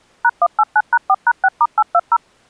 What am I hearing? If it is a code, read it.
DTMF, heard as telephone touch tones, dialled by machine, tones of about 50 ms. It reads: #189#4#6*820